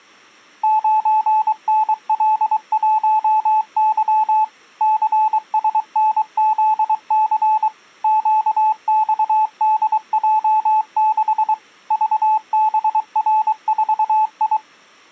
Morse code, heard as a keyed tone, machine-sent, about 23 wpm, 870 Hz. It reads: 9NL1Y CSNZC QXDJ6 VBR4I